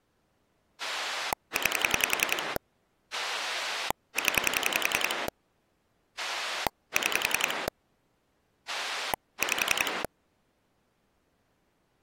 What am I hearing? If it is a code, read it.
Pulse dialling, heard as a rotary dial, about 10 pulses a second. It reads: 9 0 6 5